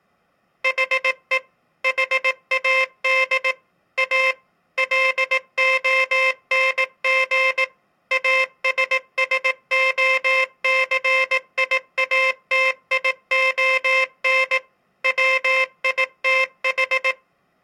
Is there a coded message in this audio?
Yes: Morse code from 0.6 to 17.2 s, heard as a buzzer, machine-sent, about 18 wpm. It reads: HE HAD A LONG ASSOCIATION WITH